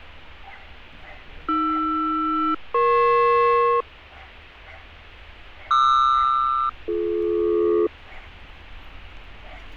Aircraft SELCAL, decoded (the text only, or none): AR-EP QR-BD